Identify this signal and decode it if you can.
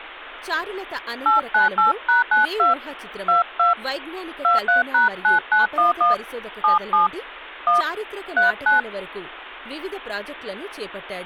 DTMF, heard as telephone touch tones, dialled by hand, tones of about 140 ms, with speech in Telugu. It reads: 898#92 22 23#9911 77 1 39